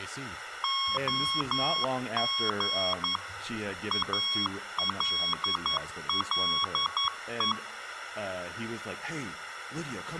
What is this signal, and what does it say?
Morse code, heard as a keyed tone, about 11 wpm, 1100 Hz, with room echo and speech in English. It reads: OG ALLE